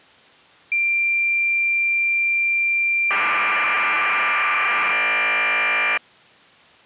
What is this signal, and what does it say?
Cassette data (Kansas City type), 1200 baud, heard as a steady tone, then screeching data.